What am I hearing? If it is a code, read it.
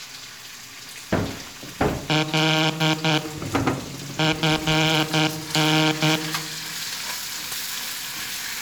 Morse code, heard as a buzzer, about 10 wpm, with room echo and kitchen noise. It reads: L FN